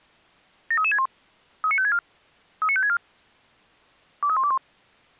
Five-tone selective call (ZVEI), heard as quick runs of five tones, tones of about 70 ms. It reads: 73361 39564 39564 23121